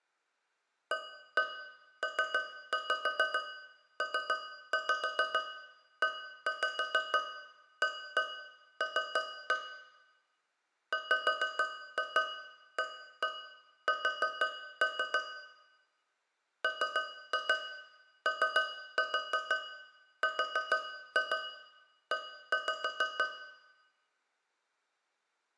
Tap code, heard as taps on a metal pipe, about 6 knocks a second, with room echo. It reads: APPEAL WAS MORE